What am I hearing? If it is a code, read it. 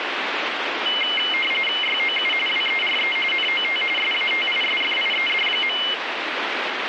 RTTY (45.45 baud, 850 Hz shift), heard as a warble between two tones, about 2550 Hz centre, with radio static. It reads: YOU WERE NOT SATISFIED.